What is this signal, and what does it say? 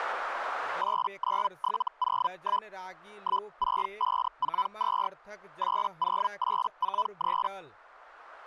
Hellschreiber (Feld-Hell, 122.5 baud), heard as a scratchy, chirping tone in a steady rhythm, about 1000 Hz, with speech in Maithili. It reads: 89701 16542 80843